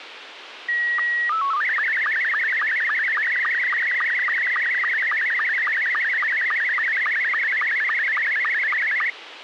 SSTV (slow-scan television), Scottie S2, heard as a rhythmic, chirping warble, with radio hiss.